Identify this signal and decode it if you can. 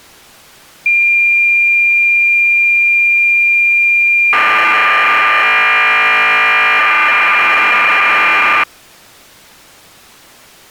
Cassette data (Kansas City type), 1200 baud, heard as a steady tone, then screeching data.